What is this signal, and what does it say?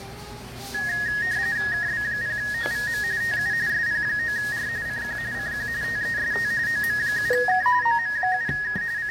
RTTY (45.45 baud, 170 Hz shift), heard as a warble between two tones, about 1750 Hz centre, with radio static and the noise of a restaurant. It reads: KB0OVM TU SP9R CQ CQ TEST OM7K OM7K …